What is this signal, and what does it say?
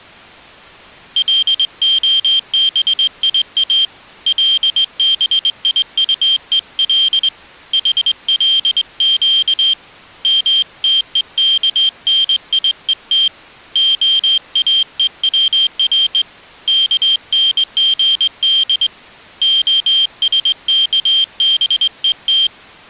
Morse code (Hebrew alphabet), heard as a high beeper, hand-sent with a straight key, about 21 wpm, 3150 Hz. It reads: להביא לביטול חלק מתוכניות האוצר כנגד השכבות